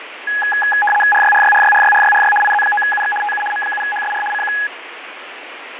RTTY (75 baud, 850 Hz shift), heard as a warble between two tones, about 1250 Hz centre, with radio static and fading. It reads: RYRYRYRYRYRY IZ9UX TU M7HSR CQ